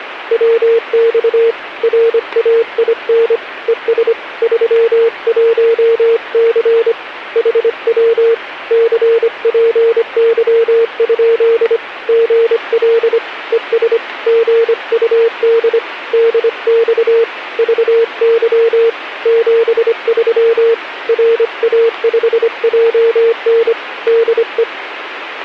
Morse code, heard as a keyed tone, hand-sent with a paddle, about 25 wpm, 460 Hz, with radio static. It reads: WX RAIN ES 31C HW CPY? GL ES GUD DX VY 73 RA5JN DE